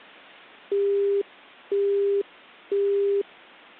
Telephone call progress tone (single-tone plan, as in Europe, Japan and elsewhere), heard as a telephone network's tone, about 400 Hz, 0.5 s on and 0.5 s off. Busy tone.